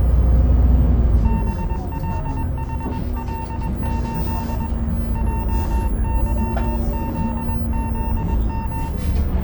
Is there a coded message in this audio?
Yes: Morse code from 1.2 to 8.9 s, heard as a keyed tone, hand-sent with a paddle, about 21 wpm, 910 Hz, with room echo and the noise inside a bus. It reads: BLHL8 JYZZM